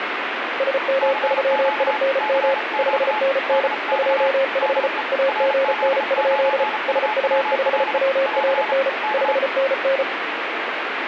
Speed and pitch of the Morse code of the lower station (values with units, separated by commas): 34 wpm, 540 Hz